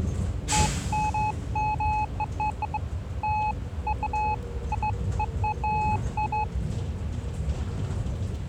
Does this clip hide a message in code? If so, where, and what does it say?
No, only beeps of irregular length, with the noise inside a bus.